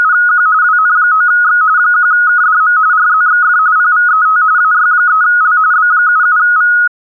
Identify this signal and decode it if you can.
RTTY (45.45 baud, 170 Hz shift), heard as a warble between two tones, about 1360 Hz centre. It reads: … WN9X 1KDM RZXF PVET AY3L B77V